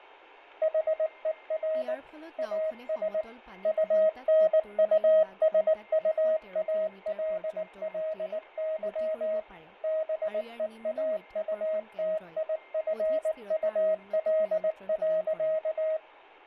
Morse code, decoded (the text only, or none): HER AS UNUSUALLY BEAUTIFUL.